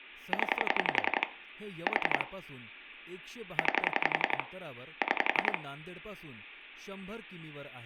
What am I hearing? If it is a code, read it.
Pulse dialling, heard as clicks on a phone line, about 11 pulses a second, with room echo and speech in Marathi. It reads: 0 4 9 6